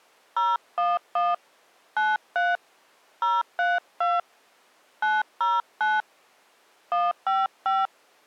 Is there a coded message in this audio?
Yes: DTMF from 0.4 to 7.9 s, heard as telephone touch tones, dialled by hand, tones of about 200 ms. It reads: 011 93 032 909 155